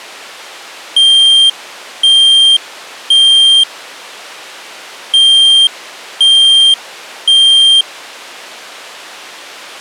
Alarm pattern, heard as an alarm's beeps, played twice, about 3200 Hz. Temporal three. Smoke or fire, evacuate.